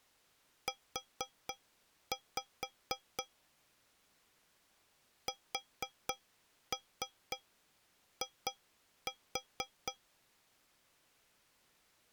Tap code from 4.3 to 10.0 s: SI

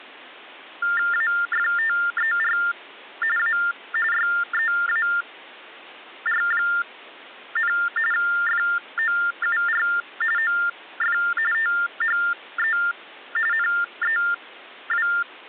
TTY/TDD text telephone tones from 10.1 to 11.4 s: OF

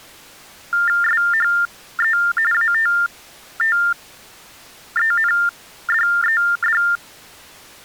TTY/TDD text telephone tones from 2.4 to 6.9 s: ATTENDED

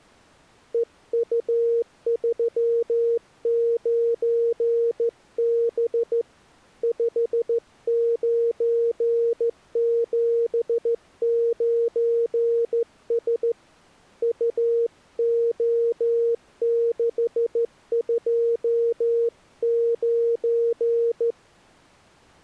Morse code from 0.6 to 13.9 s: EU39B 5979S

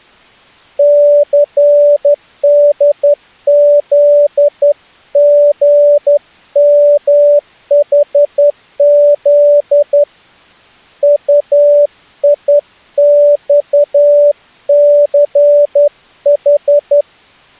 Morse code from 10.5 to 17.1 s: UIXCH

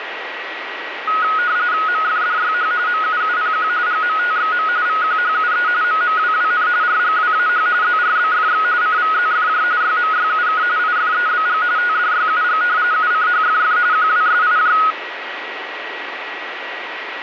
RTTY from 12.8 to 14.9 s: UCHFF QWSIJ

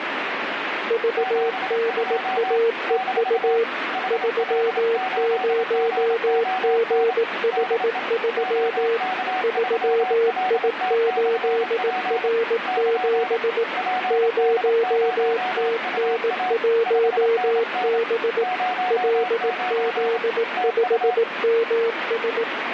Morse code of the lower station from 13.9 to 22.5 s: 0TN1B LZ5MS

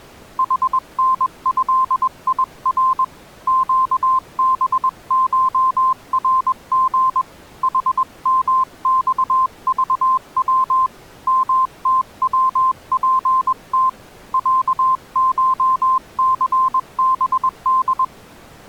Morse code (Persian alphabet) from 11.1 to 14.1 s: متوپت

